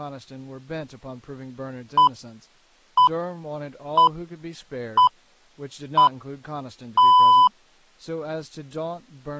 Radio time signal (six pips, as the Greenwich Time Signal), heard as pips, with speech in English.